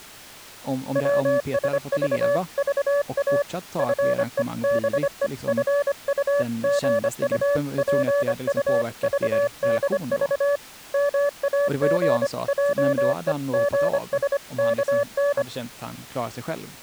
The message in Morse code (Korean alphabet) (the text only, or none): 별로 나다니시지를 못하셔요